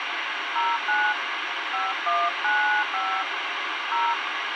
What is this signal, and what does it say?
DTMF, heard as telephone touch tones, dialled by hand, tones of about 280 ms, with radio hiss. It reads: 09 5195 0